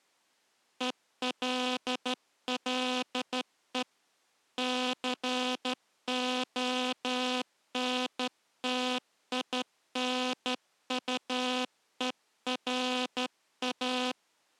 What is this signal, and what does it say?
Morse code, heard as a buzzer, hand-sent with a straight key, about 12 wpm. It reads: ELLE CONTINUERA